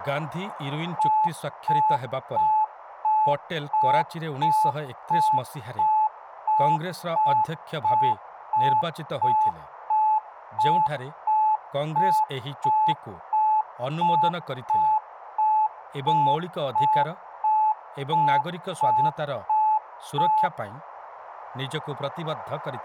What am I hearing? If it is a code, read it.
Evenly repeated beeps, with radio static, room echo and speech in Odia. There is no code.